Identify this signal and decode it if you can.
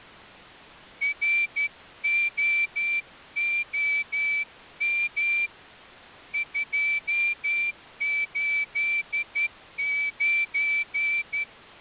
Morse code, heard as a whistle, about 12 wpm. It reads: ROOM 289